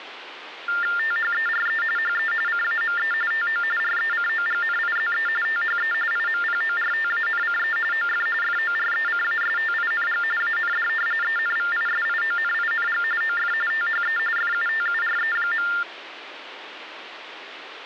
TTY/TDD text telephone tones (45.45 baud Baudot), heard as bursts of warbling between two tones, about 400 Hz shift, 1600 Hz centre, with phone line noise. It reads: THERE HE CAME TO RECOGNIZE THE IMPORTANCE OF FORECASTING AND ENVISIONING OF THE FUTURE.